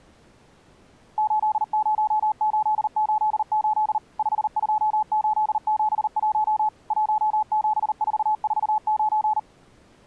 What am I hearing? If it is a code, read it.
Morse code, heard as a keyed tone, machine-sent, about 39 wpm, 860 Hz. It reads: 80888 52871 17449